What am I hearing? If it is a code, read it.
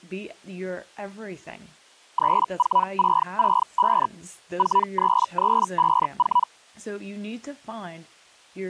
Hellschreiber (Feld-Hell, 122.5 baud), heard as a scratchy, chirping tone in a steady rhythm, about 980 Hz, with speech in English. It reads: 34665 43354